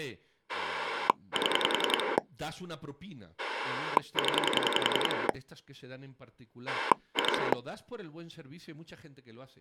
Pulse dialling, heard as a rotary dial, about 10 pulses a second, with speech in Spanish. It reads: 7 0 2